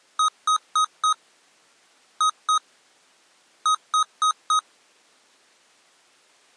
Beep code, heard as beeps from a small speaker, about 1260 Hz. 4-2-4. In Phoenix BIOS tables: unexpected interrupt in protected mode.